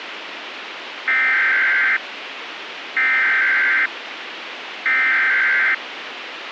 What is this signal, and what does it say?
Emergency Alert System (SAME) tones (header bursts), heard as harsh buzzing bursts, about 520.83 baud, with radio hiss.